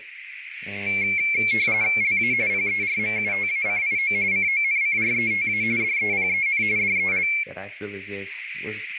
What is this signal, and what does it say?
RTTY (45.45 baud, 170 Hz shift), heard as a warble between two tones, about 2250 Hz centre, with radio static, a narrow filter and speech in English. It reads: LA PERMUTACIO CONCRETA DEPEN DEL